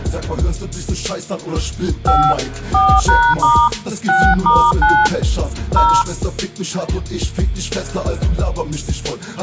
DTMF, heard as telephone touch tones, dialled by hand, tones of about 260 ms. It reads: 5 4#* 6*9 0